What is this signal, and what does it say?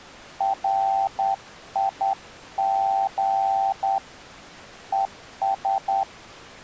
Morse code, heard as a keyed tone, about 10 wpm, 780 Hz. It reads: RIG ES